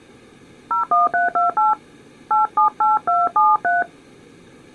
DTMF, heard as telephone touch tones, dialled by hand, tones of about 150 ms. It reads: 01328 878273